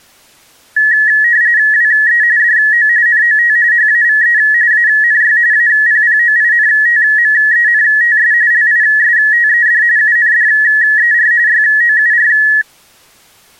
RTTY (45.45 baud, 170 Hz shift), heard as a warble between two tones, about 1800 Hz centre. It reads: WE DO NOT HAVE ANY APPOINTMENTS LISTED UNDER YOUR